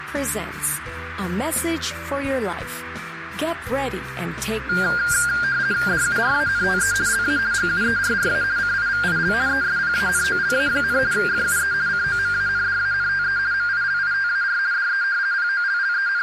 RTTY (50 baud, 170 Hz shift), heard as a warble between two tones, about 1500 Hz centre, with radio static and a narrow filter. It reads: DURANTE LA GUERRA CIVIL ESPANOLA, FUE COMANDANTE MILITAR DE …